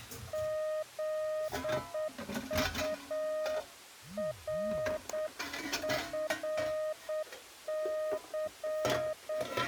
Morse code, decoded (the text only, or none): ZURFC